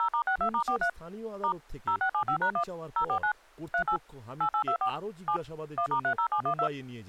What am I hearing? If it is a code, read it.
DTMF, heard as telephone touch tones, dialled by machine, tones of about 80 ms, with speech in Bangla. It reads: 0*62*43 * 0675#1 049 38 8824 7 1*30712